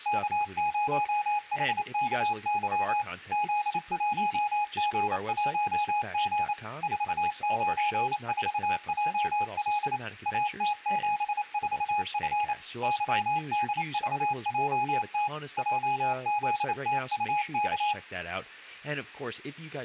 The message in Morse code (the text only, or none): K0HKY Z1G1G 494JL AT74F YDVJT JZTUK